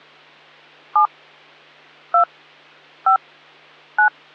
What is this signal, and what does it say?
DTMF, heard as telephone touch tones, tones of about 100 ms. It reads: 7 2 5 9